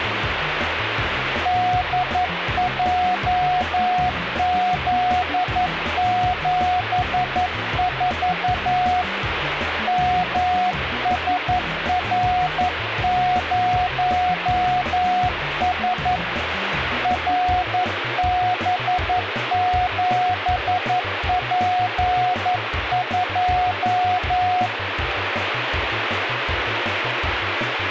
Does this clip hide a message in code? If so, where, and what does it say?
Yes: Morse code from 1.4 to 24.7 s, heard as a keyed tone, hand-sent with a paddle, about 11 wpm, 730 Hz, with radio static. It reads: DJZ74 MSR0S RB7P2